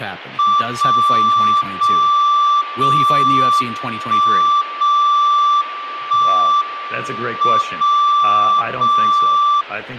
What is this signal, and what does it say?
Radio time signal (WWVB), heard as a tone whose level steps once a second, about 1170 Hz, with speech in English. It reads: 0 0 0 1 0 1 M 0 0